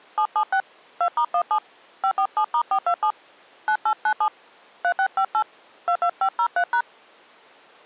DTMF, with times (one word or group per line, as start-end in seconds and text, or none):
0.2-0.6 776
1.0-1.6 2*17
2.0-3.1 547*427
3.7-4.3 9897
4.8-5.4 3658
5.9-6.8 22503#